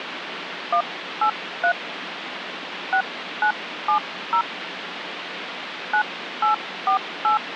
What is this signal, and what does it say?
DTMF, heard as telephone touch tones, dialled by hand, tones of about 100 ms, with phone line noise. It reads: 183 6970 9848